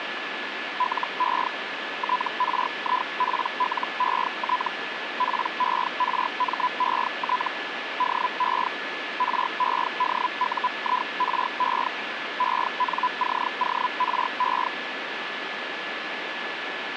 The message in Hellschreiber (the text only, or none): LE TRIPLET PERMET DE REDUIRE ENCORE